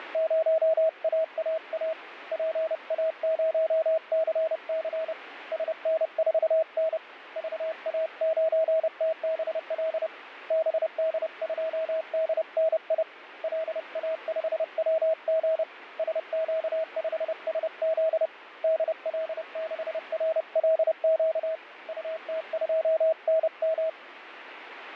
Morse code, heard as a keyed tone, hand-sent with a paddle, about 30 wpm, 640 Hz, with radio static. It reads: … PA0CC SN4N VA9TBL BD2DNI LA5WG SQ5SZ DL6RLQ UT2NM